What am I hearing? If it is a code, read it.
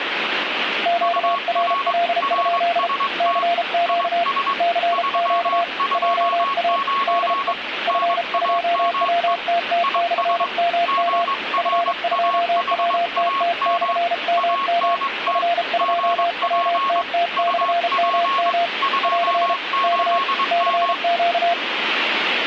Morse code, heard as two keyed tones, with radio static. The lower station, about 33 wpm, 690 Hz: QRL? CQ CQ JA DE F2WTT/MM F2WTT/MM F2WTT/MM <AR> K CQ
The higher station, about 22 wpm, 1100 Hz: UR RST IS 329 NAME IS GRAHAM ANT GP UP 28M